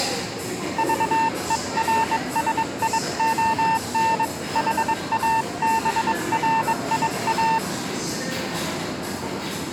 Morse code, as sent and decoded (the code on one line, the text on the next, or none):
...- . .-. ... .. --- -. / .... .- -... .-. .. .-
VERSION HABRIA